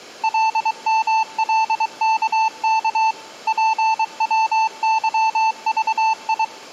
Morse code, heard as a keyed tone, machine-sent, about 23 wpm, 880 Hz. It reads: LMLKK PWYVI